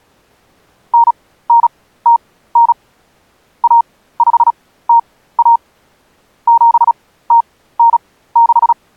Morse code (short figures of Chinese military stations), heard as a keyed tone, machine-sent, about 36 wpm, spaced as for 17 wpm, 930 Hz. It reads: 9909 1501 7096